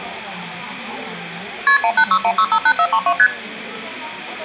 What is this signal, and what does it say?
Multi-frequency trunk signalling (R1, as on North American trunks), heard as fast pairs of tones, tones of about 70 ms, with room echo and the noise of a crowd indoors. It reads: KP 1861658432 ST